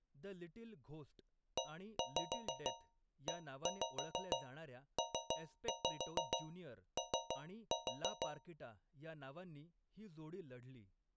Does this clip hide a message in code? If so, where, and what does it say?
Yes: tap code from 1.6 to 8.6 s, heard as taps on a metal pipe, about 6 knocks a second, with speech in Marathi. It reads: EEPO